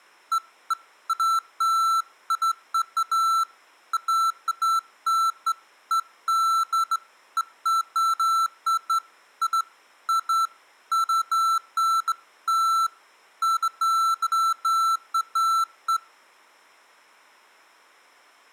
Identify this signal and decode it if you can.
Beeps of irregular length, with room echo. There is no code.